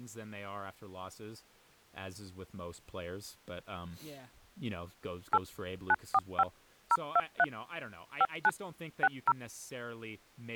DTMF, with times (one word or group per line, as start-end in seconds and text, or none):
5.3-5.4 8
5.9-6.4 945
6.9-7.4 023
8.2-8.5 59
9.0-9.3 60